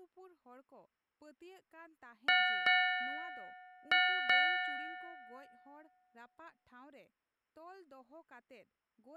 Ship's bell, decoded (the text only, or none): 4